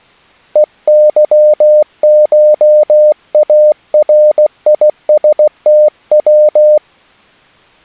Morse code (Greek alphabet), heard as a keyed tone, hand-sent with a paddle, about 16 wpm, 600 Hz. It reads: ΕΥΧΑΡΙΣΤΩ